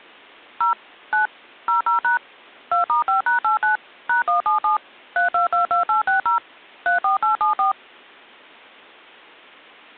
DTMF, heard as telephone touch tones, dialled by machine, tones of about 130 ms. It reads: 0 9 00# 2*5#89 #177 3222860 34874